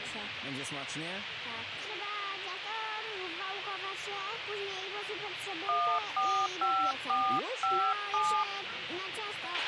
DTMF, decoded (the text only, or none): 145457